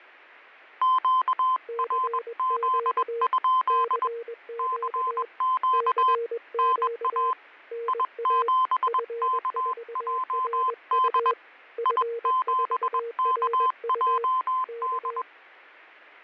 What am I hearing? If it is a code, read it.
Morse code, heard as two keyed tones, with fading. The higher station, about 21 wpm, 1030 Hz: QRZ? CQ NA I7KJD I7KJD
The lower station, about 21 wpm, 470 Hz: CQ CQ CQ NA F4RU F4RU K